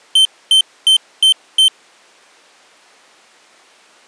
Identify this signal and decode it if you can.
Beep code, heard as a piezo beeper, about 3100 Hz. 5 short. In AMI BIOS tables: processor failure; in Dell tables: CMOS battery failure.